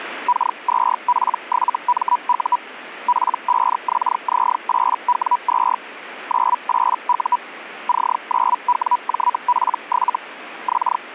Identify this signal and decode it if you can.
Hellschreiber (Feld-Hell, 122.5 baud), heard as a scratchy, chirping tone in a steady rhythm, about 980 Hz. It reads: K2P7MU P5XZ8W2 98U C9WJP7 …